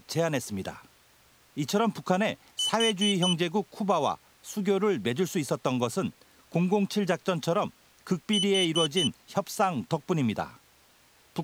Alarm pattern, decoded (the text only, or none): temporal four